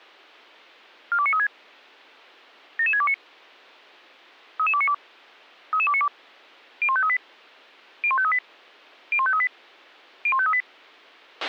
Five-tone selective call (ZVEI), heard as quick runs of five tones, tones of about 70 ms, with a squelch burst at the end. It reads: 42936 77629 33292 33292 01538 01538 01538 01538